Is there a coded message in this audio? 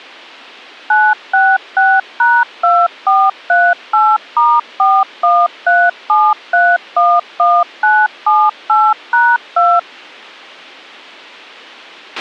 Yes: DTMF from 0.9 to 9.8 s, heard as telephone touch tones, dialled by machine, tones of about 230 ms, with a squelch burst at the end. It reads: 966#2438*4137311978#2